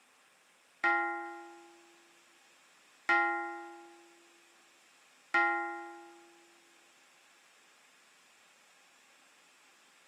Clock strike, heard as a bell. 3. Three o'clock.